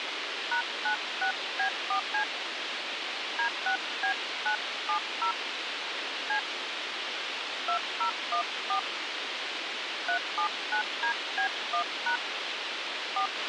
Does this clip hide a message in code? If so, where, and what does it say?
Yes: DTMF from 0.5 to 13.3 s, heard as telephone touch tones, dialled by hand, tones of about 100 ms, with radio hiss and a squelch burst at the end. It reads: #96B4C D6B970 C 2014 379DB1# 4